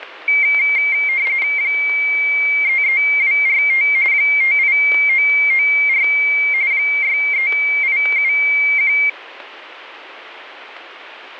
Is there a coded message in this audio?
Yes: RTTY (45.45 baud, 170 Hz shift) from 0.3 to 9.1 s, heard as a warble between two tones, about 2200 Hz centre, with static crashes. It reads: 33245 58994 63871